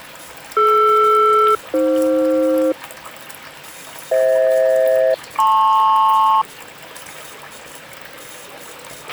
Aircraft SELCAL, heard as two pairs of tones, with a squelch burst at the end and the noise of a restroom. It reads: DR-AF FH-LP